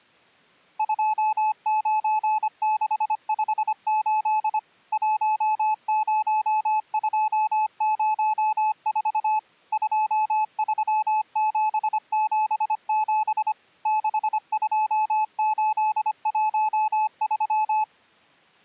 Morse code, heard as a keyed tone, machine-sent, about 25 wpm, 860 Hz. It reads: 29658 10204 23777 62813